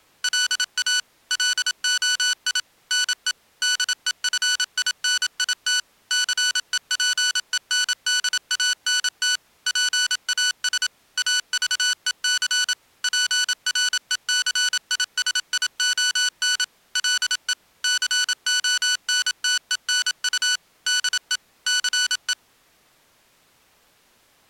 Morse code, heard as electronic beeps, machine-sent, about 27 wpm, 1490 Hz. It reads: LA LOI NE DEFINIT CEPENDANT PAS AVEC PRECISION LE CONTENU DE CE